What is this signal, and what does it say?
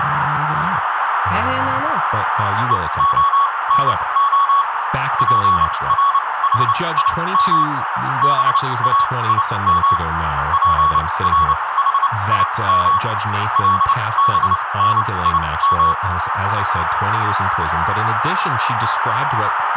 Morse code (Hebrew alphabet), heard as a keyed tone, machine-sent, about 29 wpm, spaced as for 21 wpm, 1120 Hz, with radio static, a narrow filter, room echo and speech in English. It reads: והנה פרחים באים פרחים לבנים